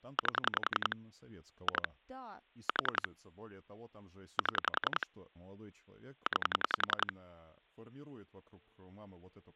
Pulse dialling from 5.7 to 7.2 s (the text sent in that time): 9